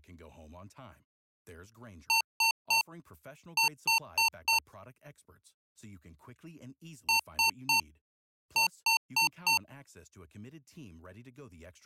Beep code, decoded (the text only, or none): 3-4